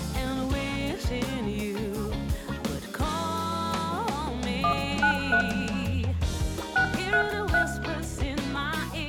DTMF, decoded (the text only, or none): 193 633